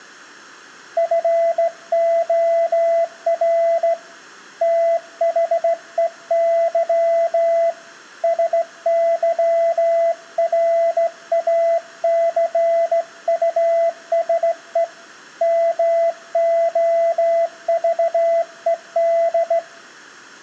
Morse code, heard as a keyed tone, hand-sent with a straight key, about 16 wpm, 670 Hz, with room echo. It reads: FOR THEY SYRACUSE MOVED